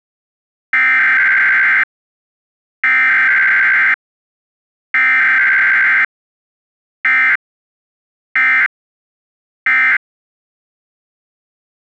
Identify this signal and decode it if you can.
Emergency Alert System (SAME) tones (header bursts, then end-of-message bursts), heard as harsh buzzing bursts, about 520.83 baud.